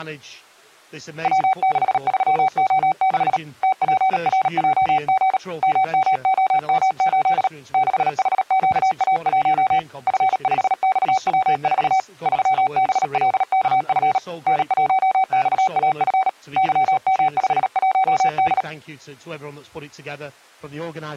Morse code, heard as a keyed tone, hand-sent with a paddle, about 37 wpm, 760 Hz. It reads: W63O6 TPRJG MMOM8 6HQA1 F5XW4 3BLKF N1XAF YM51D